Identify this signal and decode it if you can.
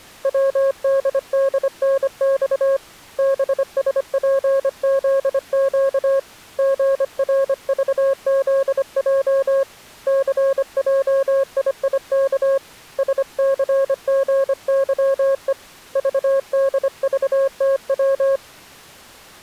Morse code, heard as a keyed tone, hand-sent with a paddle, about 25 wpm, 540 Hz. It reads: WDDNX BSPZQ GRVZJ CJIIK SCGYE VDVTW